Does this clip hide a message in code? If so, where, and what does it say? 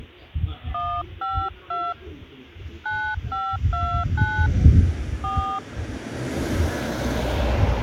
Yes: DTMF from 0.7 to 5.6 s, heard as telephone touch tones, dialled by hand, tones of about 270 ms, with the noise of a residential street. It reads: 152 9529 4